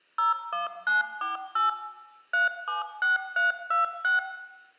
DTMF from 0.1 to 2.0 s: 01948

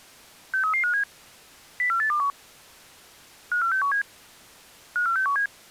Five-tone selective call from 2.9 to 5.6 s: 54617 54617

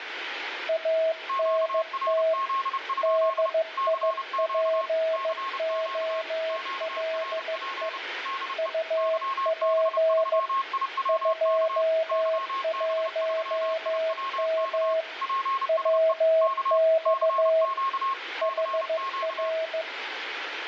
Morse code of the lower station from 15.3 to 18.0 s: WX

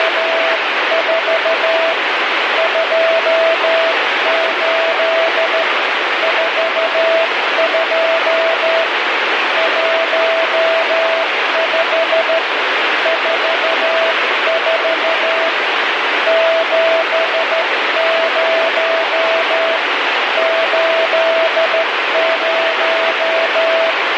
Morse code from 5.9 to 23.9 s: 42 15 44 70 80

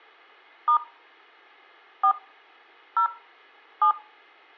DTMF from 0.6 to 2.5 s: * 4

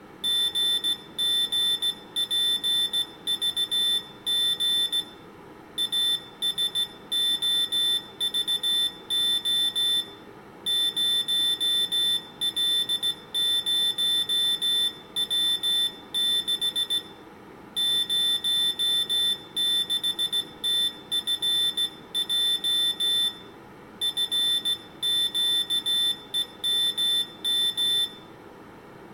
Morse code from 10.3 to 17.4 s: 0L0W6

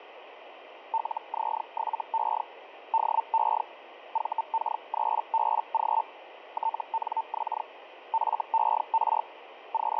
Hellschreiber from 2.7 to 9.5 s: DE VK3BG TNX FER

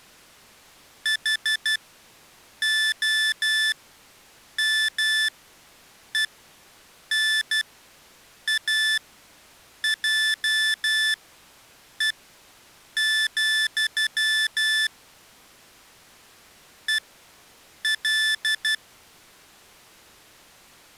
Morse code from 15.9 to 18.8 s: EL

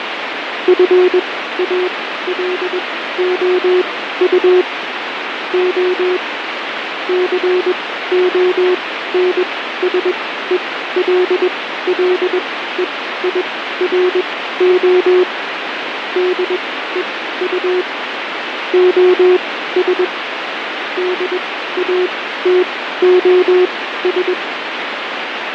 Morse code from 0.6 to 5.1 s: FALOU

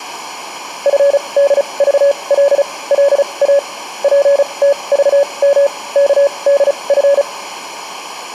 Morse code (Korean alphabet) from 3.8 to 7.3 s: 젊은

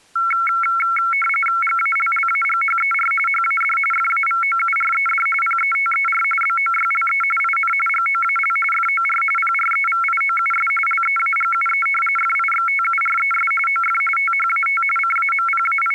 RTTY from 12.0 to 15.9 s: FIXTURES OF THAT …

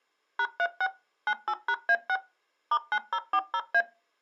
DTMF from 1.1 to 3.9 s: 98#A6 *9040A

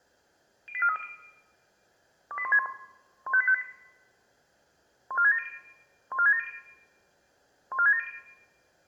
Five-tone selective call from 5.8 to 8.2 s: 14670 14670

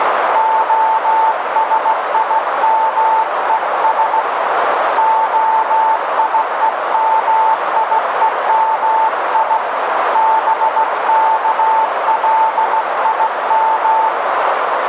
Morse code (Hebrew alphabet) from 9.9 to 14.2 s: בכלים

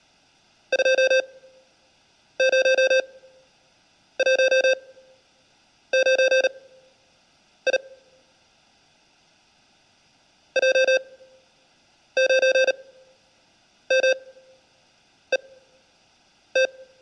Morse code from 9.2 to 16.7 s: J9MET

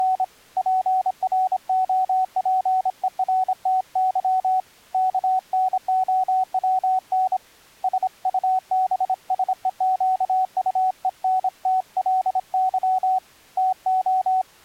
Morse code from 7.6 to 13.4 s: SUBSEQUENTLY

